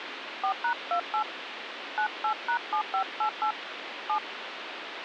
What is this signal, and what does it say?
DTMF, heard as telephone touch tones, dialled by hand, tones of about 90 ms, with phone line noise. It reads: 4#28 98#7588 7